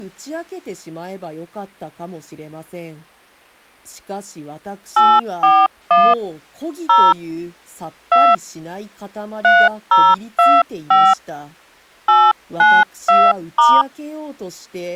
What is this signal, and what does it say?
DTMF, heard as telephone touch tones, dialled by hand, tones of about 230 ms, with speech in Japanese. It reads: 841 0 2 3025 892*